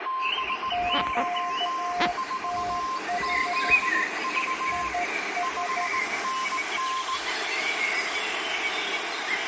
Morse code, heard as two keyed tones, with radio static, room echo and the noise of a park. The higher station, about 19 wpm, 1050 Hz: BY4ZV 5NN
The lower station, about 12 wpm, 710 Hz: QTH IS